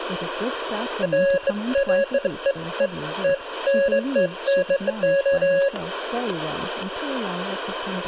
Beeps of irregular length, with static crashes and speech in English. There is no code.